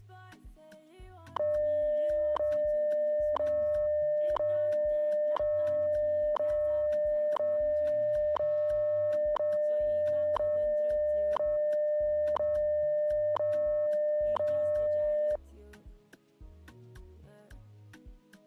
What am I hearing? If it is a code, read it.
Radio time signal (WWV, Colorado), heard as ticks, one a second.